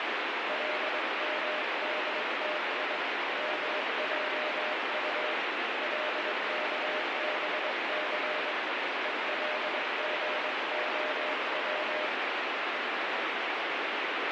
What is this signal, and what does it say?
Morse code (Hebrew alphabet), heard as a keyed tone, hand-sent with a paddle, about 22 wpm, 610 Hz, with heavy radio static. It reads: למדתי מעט לכבס ולגהץ